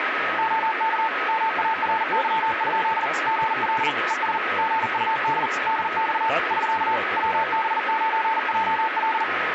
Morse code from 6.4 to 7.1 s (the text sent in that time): <SK>